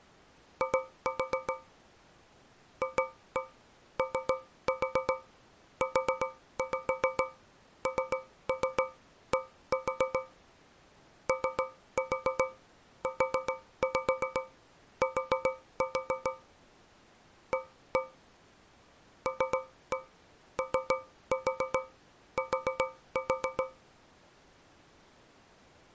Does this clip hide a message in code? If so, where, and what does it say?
Yes: tap code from 0.6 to 23.9 s, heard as taps on a metal pipe, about 7 knocks a second. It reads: I FOUND OUT A LOT